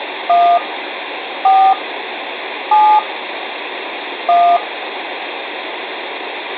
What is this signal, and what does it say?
DTMF, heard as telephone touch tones, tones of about 280 ms, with phone line noise. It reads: 1 4 7 1